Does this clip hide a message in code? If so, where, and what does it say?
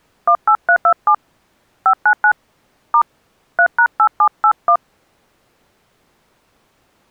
Yes: DTMF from 0.3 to 4.8 s, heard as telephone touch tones, dialled by hand, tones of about 80 ms. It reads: 18327 599 * 3#8781